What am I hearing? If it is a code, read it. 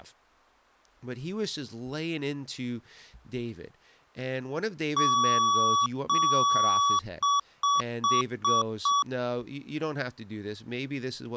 Beep code, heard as beeps from a small speaker, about 1140 Hz, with speech in English. 2 long, 5 short.